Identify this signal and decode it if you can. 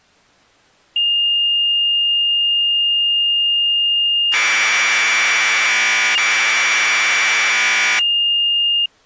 Commodore tape loading (standard loader), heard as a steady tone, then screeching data.